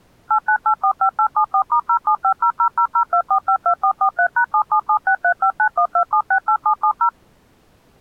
DTMF, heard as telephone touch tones, dialled by machine, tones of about 80 ms. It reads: 89845874*07500002452443#777635912768770